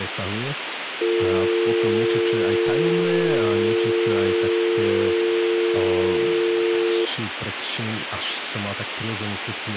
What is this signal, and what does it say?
Telephone call progress tone (North American or UK plan), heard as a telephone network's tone, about 350, 450 Hz, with phone line noise and speech in Slovak. Dial tone.